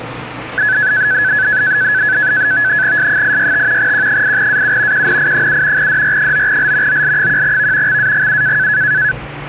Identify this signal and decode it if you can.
NAVTEX (SITOR-B), 100 baud, 170 Hz shift, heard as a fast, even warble, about 1600 Hz centre, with the noise inside a lift. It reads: S865 Q8AU QNI7 DR9L OL1V XAGU